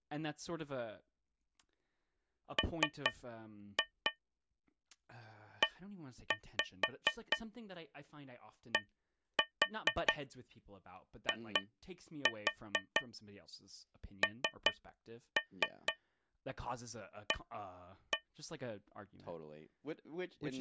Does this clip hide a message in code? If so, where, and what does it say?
Yes: tap code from 2.6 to 18.3 s, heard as taps on a metal pipe, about 4 knocks a second, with speech in English. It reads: MEDINA